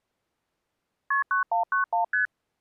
Multi-frequency trunk signalling (R1, as on North American trunks), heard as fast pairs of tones, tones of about 120 ms. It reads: KP 9191 ST